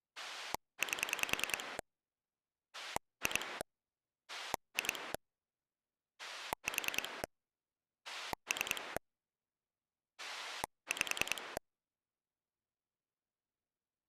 Pulse dialling, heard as a rotary dial, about 10 pulses a second. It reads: 8 2 2 4 3 5